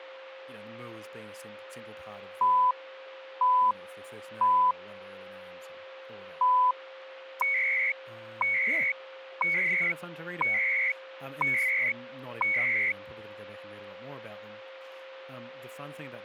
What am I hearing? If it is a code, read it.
Radio time signal (CHU, Canada), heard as beeps and data bursts, one a second, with a steady whistle near 530 Hz and speech in English.